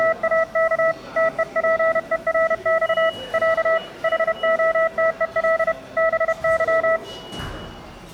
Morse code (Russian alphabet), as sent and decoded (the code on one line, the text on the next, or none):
… / - . .--. . .-. -..- / .-.- / .... --- - . .-.. / -... -.--
… ТЕПЕРЬ Я ХОТЕЛ БЫ